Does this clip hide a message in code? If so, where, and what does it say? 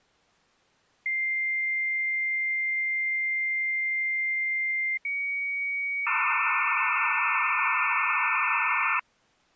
Yes: dial-up modem handshake (low-speed, two carriers) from 1.1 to 9.0 s, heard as two whistles, then hiss.